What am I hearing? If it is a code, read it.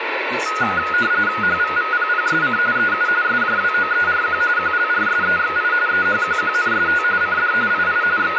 RTTY (45.45 baud, 170 Hz shift), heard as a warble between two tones, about 1360 Hz centre, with radio static and speech in English. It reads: HVVPPSC EU SJWOERQ QLRSEXI EHQQNST CD II …